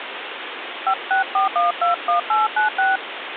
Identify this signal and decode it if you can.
DTMF, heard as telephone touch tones, dialled by hand, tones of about 120 ms, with phone line noise. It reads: 564121896